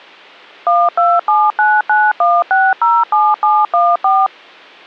DTMF, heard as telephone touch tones, dialled by machine, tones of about 220 ms. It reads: 127991607714